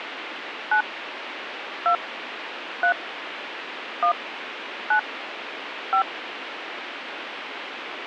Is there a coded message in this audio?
Yes: DTMF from 0.7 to 6.0 s, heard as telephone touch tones, dialled by hand, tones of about 90 ms, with radio hiss. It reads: 9 2 3 1 9 5